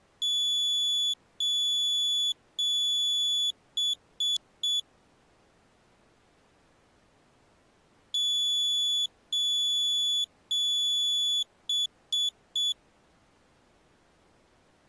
Beep code, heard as a piezo beeper, played twice, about 3450 Hz. 3 long, 3 short.